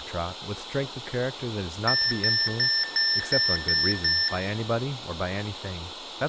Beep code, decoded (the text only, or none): 7 short